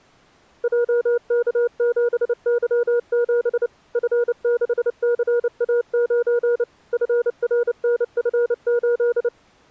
Morse code, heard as a keyed tone, machine-sent, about 29 wpm, 480 Hz. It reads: JK7Y7 F6CA9 FRNF8